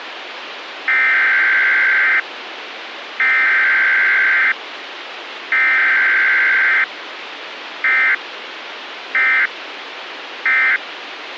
Emergency Alert System (SAME) tones (header bursts, then end-of-message bursts), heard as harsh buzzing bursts, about 520.83 baud, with radio hiss.